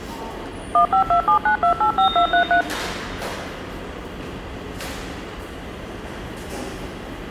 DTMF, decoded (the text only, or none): 15279285233